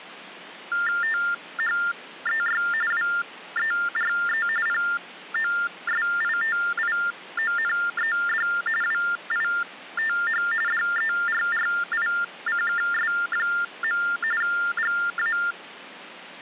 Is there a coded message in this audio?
Yes: TTY/TDD text telephone tones (45.45 baud Baudot) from 0.7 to 15.5 s, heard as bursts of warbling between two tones, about 400 Hz shift, 1600 Hz centre. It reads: THEY WERE POSITIONED WITH DERRICKS. GA